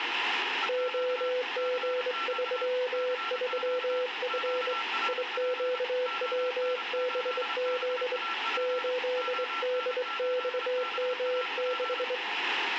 Morse code, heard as a keyed tone, hand-sent with a straight key, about 23 wpm, 500 Hz, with radio static, a weaker station near 1350 Hz and room echo. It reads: OG33F IQWBZ 8DXM6